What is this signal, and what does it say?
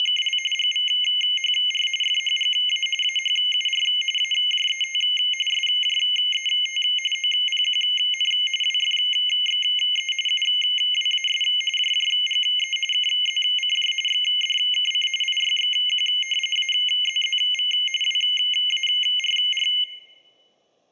RTTY (45.45 baud, 850 Hz shift), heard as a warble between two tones, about 2550 Hz centre. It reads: … GVHR FHGA AHUR AJET SJET OPQN WFXE UWAS JJGE KZCJ XDKC IYXQ AZZV WARR